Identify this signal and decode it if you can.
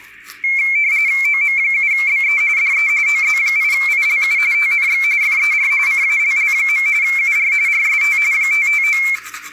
RTTY (45.45 baud, 170 Hz shift), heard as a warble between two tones, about 2250 Hz centre, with the noise of a restroom. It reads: OM7BE DE OZ8ILU TNX FER CALL. UR RST 559